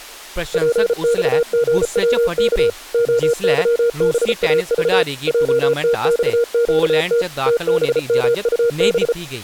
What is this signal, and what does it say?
Morse code, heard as a keyed tone, machine-sent, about 34 wpm, 470 Hz, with speech in Dogri. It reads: PXGWK OYBAV JTXQT TBMUB